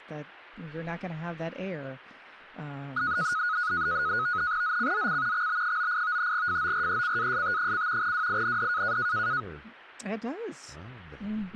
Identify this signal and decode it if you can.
NAVTEX (SITOR-B), 100 baud, 170 Hz shift, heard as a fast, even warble, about 1360 Hz centre, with speech in English. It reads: ZCZC XB98 FORECAST: WIND